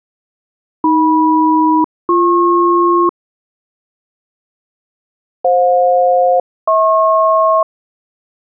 Aircraft SELCAL, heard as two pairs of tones. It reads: AM-BP FJ-HP